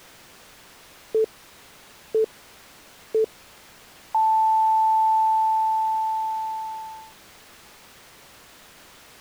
Radio time signal (three low pips and a long one an octave up, as on NHK), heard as pips.